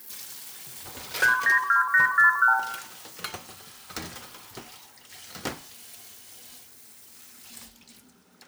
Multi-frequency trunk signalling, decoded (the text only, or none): 392841